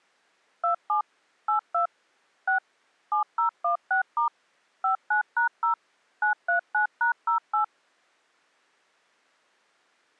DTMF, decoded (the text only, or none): 27 82 6 7016* 59#0 939#08